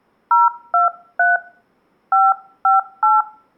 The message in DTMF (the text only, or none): 023 558